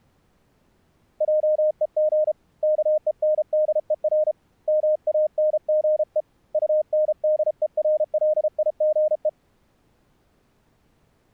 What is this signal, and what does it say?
Morse code, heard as a keyed tone, hand-sent with a paddle, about 33 wpm, 610 Hz. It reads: JEG KENDER MANGE UNDERLIGE